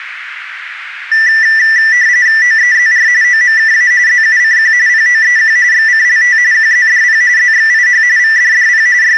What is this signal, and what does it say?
RTTY (45.45 baud, 170 Hz shift), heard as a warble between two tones, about 1850 Hz centre, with radio static. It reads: OEZR OMKA ZUCQ POEQ XCLT QZDP ZXIH VDDP …